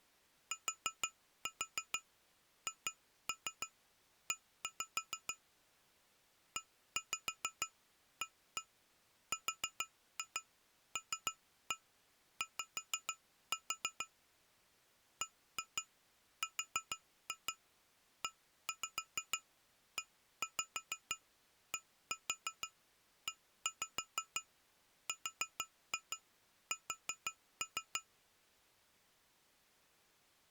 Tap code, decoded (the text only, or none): THE EARLY BREEDERS